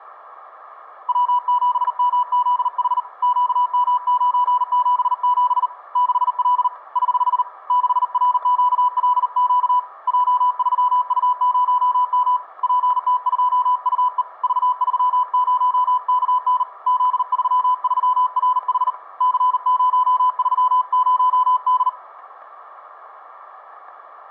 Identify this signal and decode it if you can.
Morse code, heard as a keyed tone, hand-sent with a paddle, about 39 wpm, 990 Hz, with static crashes. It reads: W7MZH QM977 6L <HH> 6RQLQ J3U0M PT2UE V30KN Z33RH C030D